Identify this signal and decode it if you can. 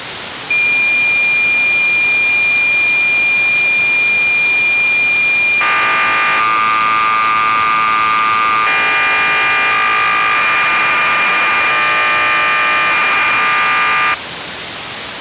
Cassette data (Kansas City type), 1200 baud, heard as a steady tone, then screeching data, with tape hiss.